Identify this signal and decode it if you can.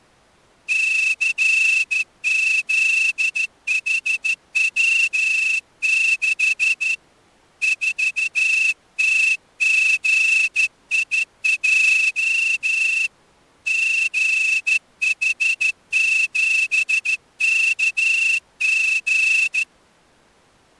Morse code, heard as a whistle, hand-sent with a straight key, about 13 wpm. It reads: CZHW6 4TGIJ GH7KG